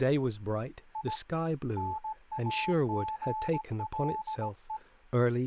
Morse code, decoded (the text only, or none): I NAGLE